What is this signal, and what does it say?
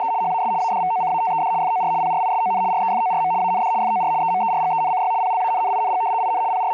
RTTY (75 baud, 170 Hz shift), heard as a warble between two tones, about 820 Hz centre, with a steady whistle near 430 Hz. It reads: … HAS ADVOCATED FOR PRISON REFORM AND FOR EMERGENCY PLANNING IN …